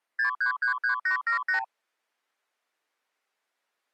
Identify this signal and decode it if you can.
Multi-frequency trunk signalling (R2, with the far end's replies), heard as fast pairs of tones, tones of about 110 ms. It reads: 6333878